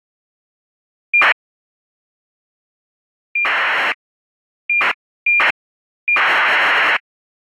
ACARS aircraft data, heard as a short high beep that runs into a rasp, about 2400 baud.